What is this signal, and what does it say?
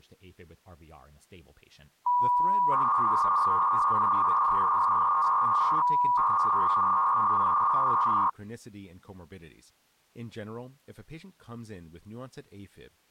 300-baud modem data (V.21 tones), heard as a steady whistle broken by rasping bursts, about 300 baud, 200 Hz shift, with speech in English.